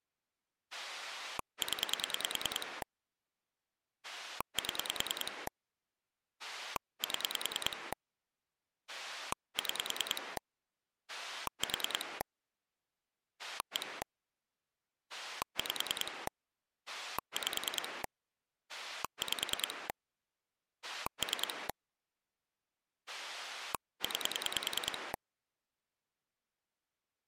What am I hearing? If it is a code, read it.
Pulse dialling, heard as a rotary dial, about 10 pulses a second. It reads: 0 7 7 6 4 1 5 5 5 3 9